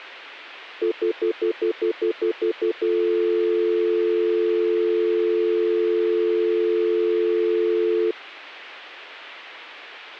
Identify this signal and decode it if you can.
Telephone call progress tone (North American plan), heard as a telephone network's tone, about 350, 440 Hz, 0.1 s on and 0.1 s off. Stutter dial tone.